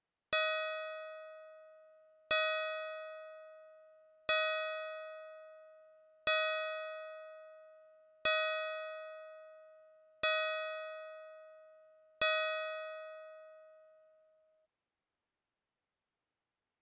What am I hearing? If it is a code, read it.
Clock strike, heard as a bell. 7. Seven o'clock.